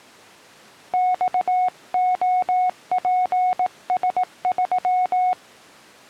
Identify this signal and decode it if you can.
Morse code, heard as a keyed tone, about 18 wpm, 730 Hz. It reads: XOPS3